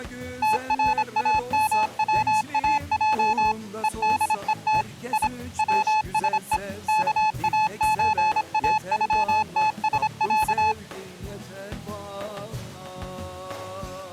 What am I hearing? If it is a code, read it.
Morse code (Russian alphabet), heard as a keyed tone, machine-sent, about 26 wpm, 860 Hz. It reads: ТРАМВАЙ ЕДЕТ И ВСЕ КАЧАЮТСЯ